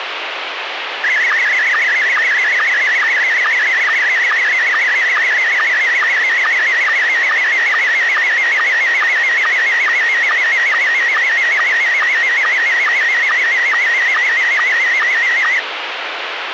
SSTV (slow-scan television), Scottie S1, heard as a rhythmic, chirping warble, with radio hiss.